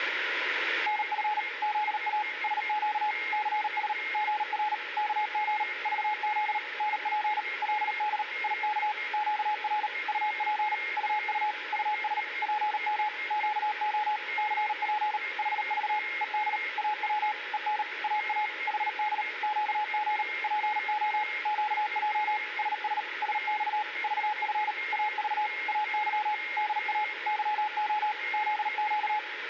Morse code, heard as a keyed tone, machine-sent, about 38 wpm, 850 Hz, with radio static, a weaker station near 2130 Hz and room echo. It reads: NF ZA SQ CS GR KG VZ NP LD IK QR UP UU US PM QO CP HV ED AW EN AA HD QG PO QJ SS SX VF AV AY DA YO ZQ